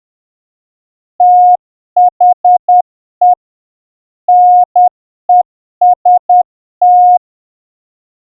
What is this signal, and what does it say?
Morse code, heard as a keyed tone, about 10 wpm, 720 Hz. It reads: THE NEST